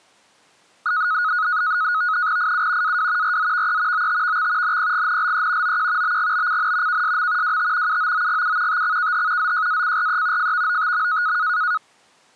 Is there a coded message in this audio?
Yes: NAVTEX (SITOR-B), 100 baud, 170 Hz shift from 0.9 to 11.8 s, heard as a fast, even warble, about 1360 Hz centre. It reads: IU AW RZVE OTVX NPGNLE OQ BGBCN KSM WT UOOGU TXKH ZJACRE FVOTM